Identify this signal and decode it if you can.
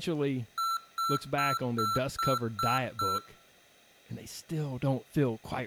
Beep code, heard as beeps from a small speaker, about 1340 Hz, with room echo and speech in English. 7 short. In AMI BIOS tables: virtual mode exception error; in Dell tables: processor failure.